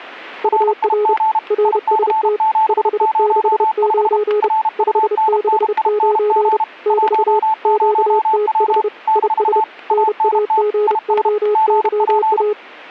Morse code, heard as two keyed tones, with static crashes. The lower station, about 30 wpm, 420 Hz: UR RST 569 569 <BT> QTH IS NAGOYA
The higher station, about 32 wpm, 880 Hz: RIG IC705 RUNNING 10W - ANT IS GP